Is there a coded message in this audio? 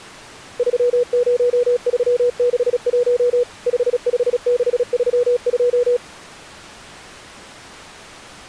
Yes: Morse code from 0.5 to 6.0 s, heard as a keyed tone, machine-sent, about 36 wpm, 490 Hz. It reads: 30361 55632